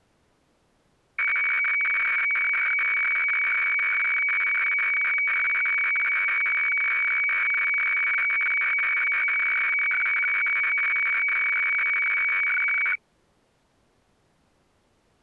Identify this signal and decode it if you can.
Weather fax (radiofax), 120 lines a minute, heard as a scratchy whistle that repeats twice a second.